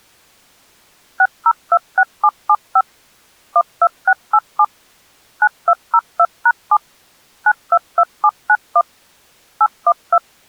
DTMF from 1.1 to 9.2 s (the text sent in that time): 6026775 12687 9202#7 922791